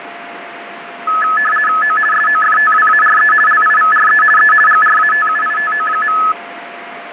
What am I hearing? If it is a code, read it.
RTTY (50 baud, 450 Hz shift), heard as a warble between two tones, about 1500 Hz centre, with radio static and a steady whistle near 690 Hz. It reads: O SOFTWARE LIVRE E GRATUITO.